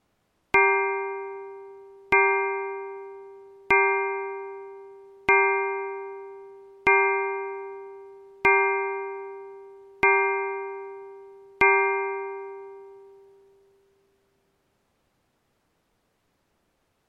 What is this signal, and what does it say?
Clock strike, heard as a bell. 8. Eight o'clock.